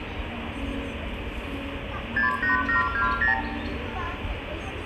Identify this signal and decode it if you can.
Multi-frequency trunk signalling (R2, with the far end's replies), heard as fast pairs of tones, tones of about 130 ms, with phone line noise, room echo and the noise of a park. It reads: 68720